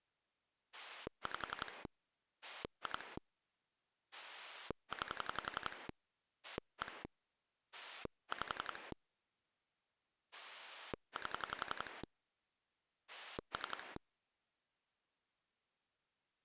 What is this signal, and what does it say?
Pulse dialling, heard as a rotary dial, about 11 pulses a second. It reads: 5 2 9 1 5 8 3